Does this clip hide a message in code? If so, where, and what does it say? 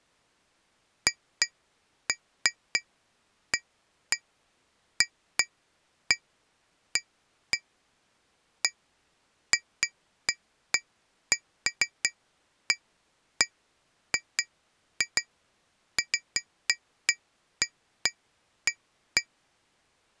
No, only irregular taps on glass.